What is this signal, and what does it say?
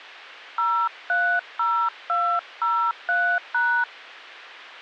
DTMF, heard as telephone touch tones, dialled by hand, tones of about 300 ms. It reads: 030203#